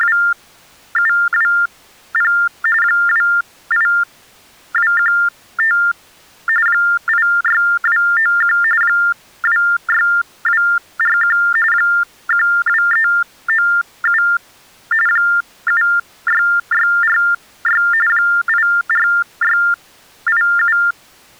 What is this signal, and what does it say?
TTY/TDD text telephone tones (45.45 baud Baudot), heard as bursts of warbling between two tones, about 400 Hz shift, 1600 Hz centre. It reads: … 28215 86291 26241 12397 76646 84687